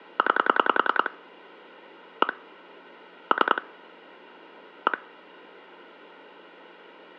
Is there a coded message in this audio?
Yes: pulse dialling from 0.2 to 4.9 s, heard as clicks on a phone line, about 10 pulses a second. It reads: 9 1 3 1